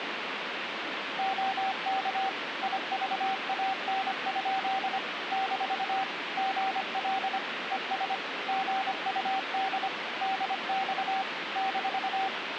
Morse code, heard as a keyed tone, machine-sent, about 25 wpm, 770 Hz, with radio static. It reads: OK IVAN? - GL ES GUD DX -